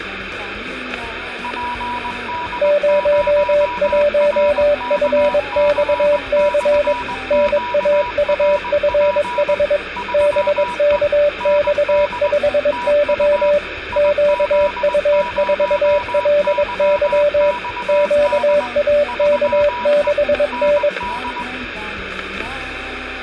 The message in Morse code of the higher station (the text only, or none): PD0RKC/QRP 3E ND TU IZ0YXD 3E ND